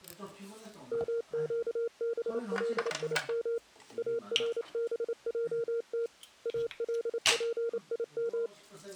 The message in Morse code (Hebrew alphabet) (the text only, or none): מקבלים ארבעת אלפים